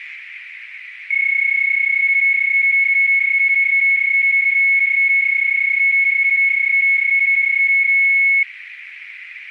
PSK31 (31.25 baud), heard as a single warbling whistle, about 2200 Hz, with radio static and a narrow filter.